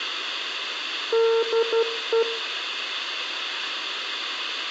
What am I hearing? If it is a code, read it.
Morse code, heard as a keyed tone, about 12 wpm, 460 Hz, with room echo. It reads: DE